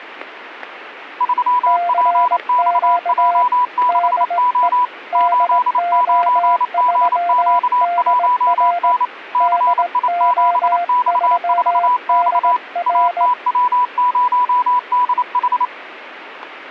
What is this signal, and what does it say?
Morse code, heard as two keyed tones. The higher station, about 28 wpm, 990 Hz: 3PXJ6O 89GQ1N CI7X4X ATW0DH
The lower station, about 19 wpm, 700 Hz: CQ DE DO3DR DO3DR